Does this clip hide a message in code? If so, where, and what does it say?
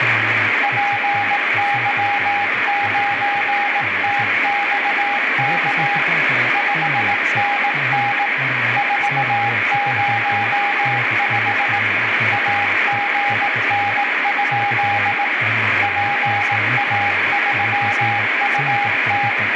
Yes: Morse code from 0.6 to 19.4 s, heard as a keyed tone, hand-sent with a paddle, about 18 wpm, 810 Hz, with heavy radio static, room echo and speech in Finnish. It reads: PY9TXK 5NN 405 AGN? PA3UT